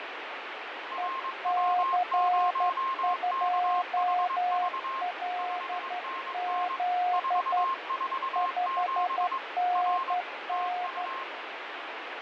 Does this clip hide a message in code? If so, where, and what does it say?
Yes: Morse code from 0.9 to 11.3 s, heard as two keyed tones, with radio static and fading. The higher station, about 22 wpm, 1060 Hz: RW0KHV 5NN 447 R TU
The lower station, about 12 wpm, 720 Hz: EC2LZ 5NN